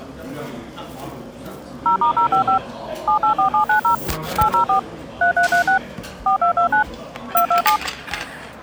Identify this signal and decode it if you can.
DTMF, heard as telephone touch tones, dialled by machine, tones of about 100 ms, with the noise of a restaurant. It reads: 0*055 784790 804 3336 4229 227